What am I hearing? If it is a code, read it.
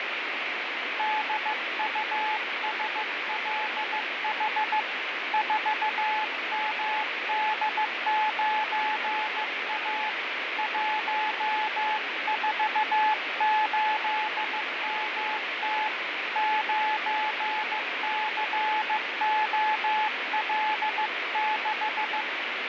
Morse code, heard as a keyed tone, hand-sent with a bug key, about 15 wpm, 860 Hz, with heavy radio static and fading. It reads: DUSLH 4MD9A 148MT 9COL6